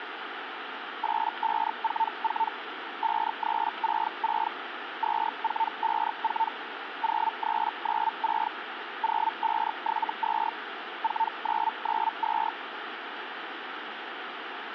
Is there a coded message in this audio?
Yes: Hellschreiber (Feld-Hell, 122.5 baud) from 1.0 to 12.5 s, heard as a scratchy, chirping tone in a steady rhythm, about 900 Hz, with radio static. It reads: 8544 5366 2454 0396 0572 4992